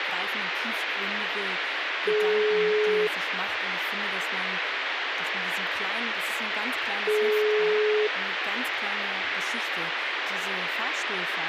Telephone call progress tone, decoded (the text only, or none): ringback tone